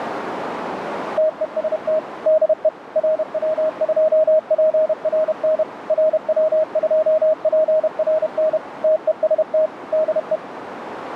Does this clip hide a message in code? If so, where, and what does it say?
Yes: Morse code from 1.1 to 10.4 s, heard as a keyed tone, machine-sent, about 31 wpm, 630 Hz, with radio static and a narrow filter. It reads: TEST DE RW2PRN RW2PRN TEST DE